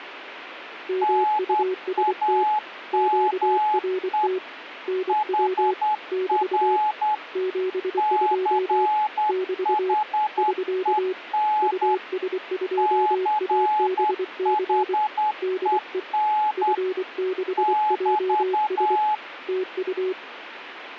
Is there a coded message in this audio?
Yes: Morse code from 0.8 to 20.2 s, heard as two keyed tones, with radio static. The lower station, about 24 wpm, 370 Hz: MUST QRT NW <BT> 72 <BT> <SK> US2ABC DE F6JS TU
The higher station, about 10 wpm, 850 Hz: NAME HR CHEN CHEN <BT>